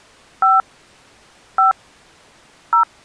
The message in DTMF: 5 5 0

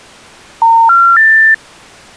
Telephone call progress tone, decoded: special information tone

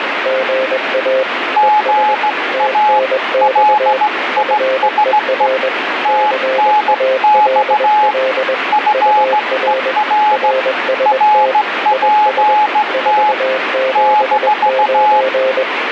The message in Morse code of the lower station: GA ES TNX FER CALL UR RST IS 479

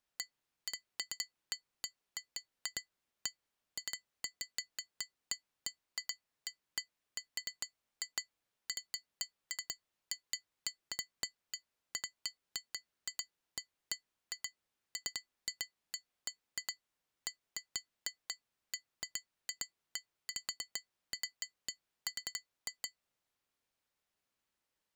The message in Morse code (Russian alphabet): none

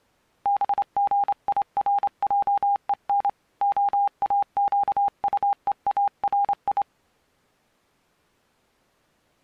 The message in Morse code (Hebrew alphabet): בגירעון האקטוארי

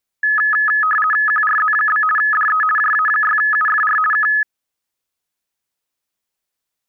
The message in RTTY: QRZ? DE JA6UFR K

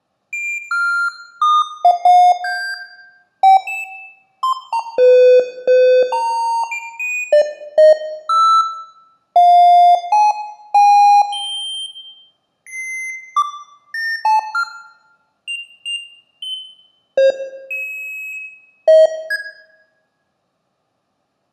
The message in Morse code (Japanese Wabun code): none

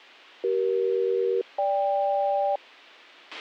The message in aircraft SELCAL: CE-GK

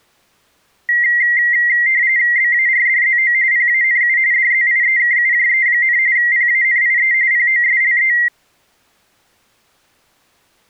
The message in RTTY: BARDZO PANU DZIEKUJE, PANIE POSLE

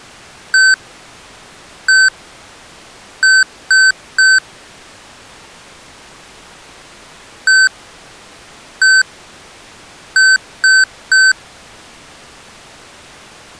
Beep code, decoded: 1-1-3

